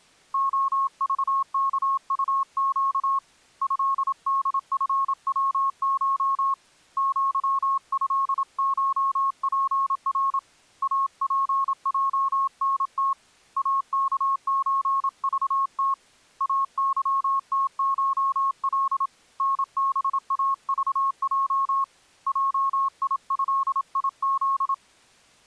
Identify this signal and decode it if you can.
Morse code (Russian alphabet), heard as a keyed tone, hand-sent with a paddle, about 27 wpm, 1090 Hz. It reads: ОЖКУЩ ЭДФВШ ЪЭШПР АПЙНТ АКЧЖТ АЫТШЛ НБАЖЙ ЙИЭИЗ